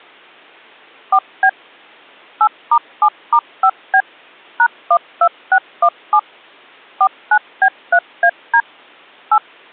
DTMF, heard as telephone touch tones, dialled by machine, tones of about 70 ms. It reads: 4B 8*7*5B #12617 49B3AD 8